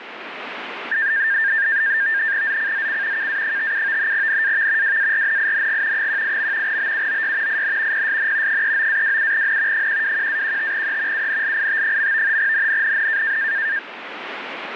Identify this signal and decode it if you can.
NAVTEX (SITOR-B), 100 baud, 170 Hz shift, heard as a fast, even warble, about 1700 Hz centre, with radio static. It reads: ZCZC KA57 NAV WARNING 18. BUOY IN PSN 39-27N 121-15E UNLIT. NNNN